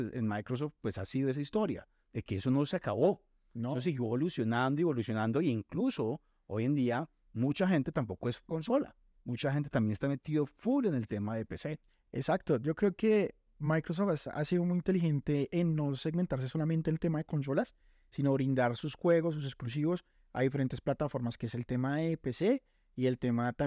Speech in Spanish. There is no code.